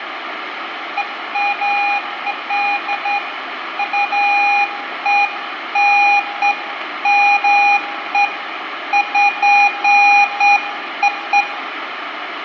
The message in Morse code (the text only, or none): none